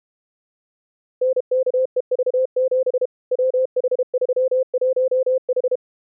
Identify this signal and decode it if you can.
Morse code, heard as a keyed tone, machine-sent, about 32 wpm, 520 Hz. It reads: NKEV7 WH31H